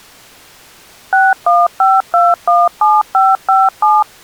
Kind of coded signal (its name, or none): DTMF